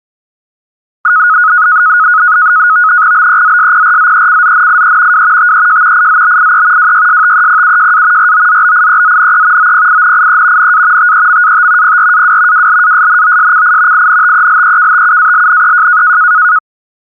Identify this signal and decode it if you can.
NAVTEX (SITOR-B), 100 baud, 170 Hz shift, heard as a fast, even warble, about 1360 Hz centre. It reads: BEZSPRZECZNIE W TEJ IZBIE WYSTEPUJA ROZBIEZNE OPINIE NA TEMAT PRAW WLASNOSCI INTELEKTUALNEJ